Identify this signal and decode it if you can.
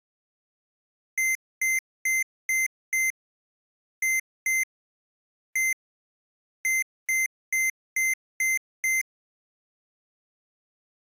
Beep code, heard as beeps from a small speaker, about 2100 Hz. 5-2-1-6.